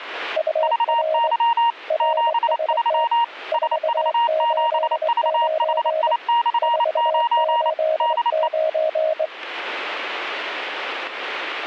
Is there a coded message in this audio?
Yes: Morse code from 0.3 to 9.3 s, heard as two keyed tones. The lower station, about 23 wpm, 630 Hz: UR RST 489 489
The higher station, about 28 wpm, 940 Hz: VY 73 SV7VHI/9 DE